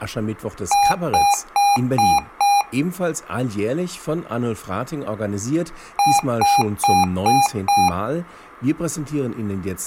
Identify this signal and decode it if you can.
Beep code, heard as beeps from a small speaker, played twice, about 810 Hz, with speech in German. 5 short. In AMI BIOS tables: processor failure; in Dell tables: CMOS battery failure.